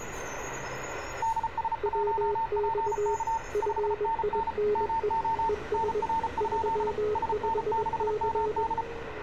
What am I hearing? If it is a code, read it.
Morse code, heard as two keyed tones, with radio static and street noise. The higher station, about 34 wpm, 900 Hz: DS1PK 5NN MO NR? SN6MD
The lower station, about 21 wpm, 420 Hz: WX FINE ES 35C